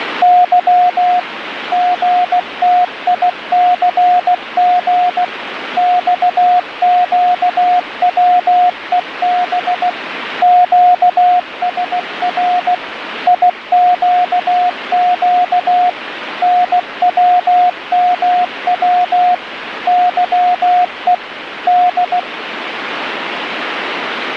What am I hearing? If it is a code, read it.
Morse code, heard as a keyed tone, machine-sent, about 16 wpm, 720 Hz, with radio static. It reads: Y GTICG XQWEB QSR IQQ NWMW YE D